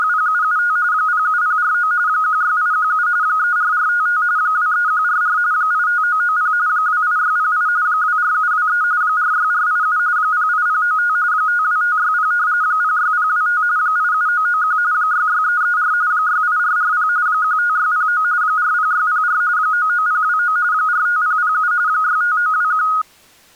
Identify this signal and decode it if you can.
RTTY (45.45 baud, 170 Hz shift), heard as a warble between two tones, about 1350 Hz centre. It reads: … 07049 16817 34455 23144 85990 28608 24723 46487 08095 52560 06025 87991 66334 68440 15609 40604 99029 45007 65921